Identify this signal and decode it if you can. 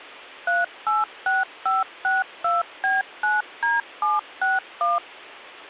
DTMF, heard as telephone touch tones, dialled by machine, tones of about 180 ms. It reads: 386562B9D761